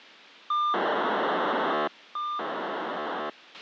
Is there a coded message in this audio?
Yes: POCSAG pager data (2400 baud) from 0.5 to 3.3 s, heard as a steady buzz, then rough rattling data, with a squelch burst at the end.